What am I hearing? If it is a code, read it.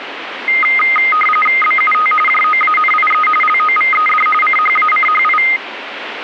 RTTY (45.45 baud, 850 Hz shift), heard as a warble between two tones, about 1650 Hz centre, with radio static. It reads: BUT JOANIE LOVED CHACHI